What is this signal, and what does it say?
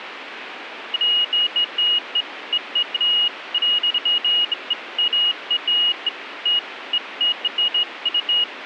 Beeps of irregular length. There is no code.